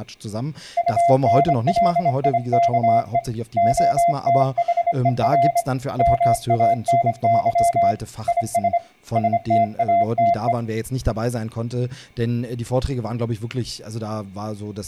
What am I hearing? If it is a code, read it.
Morse code, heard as a keyed tone, hand-sent with a straight key, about 26 wpm, 690 Hz, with speech in German. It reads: UNLIKE OTHER MANY IS STATE